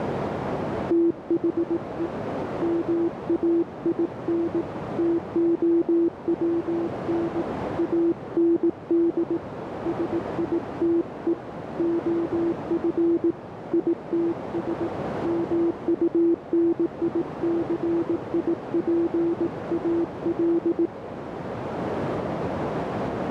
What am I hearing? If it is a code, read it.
Morse code, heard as a keyed tone, hand-sent with a paddle, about 18 wpm, 340 Hz, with heavy radio static and a narrow filter. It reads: THE MAIN TOWN AND SITE OF ITS MUNICIPAL